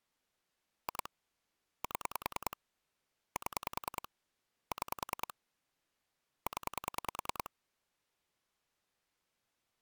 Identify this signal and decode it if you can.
Pulse dialling, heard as clicks on a phone line, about 10 pulses a second. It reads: 2 7 7 6 0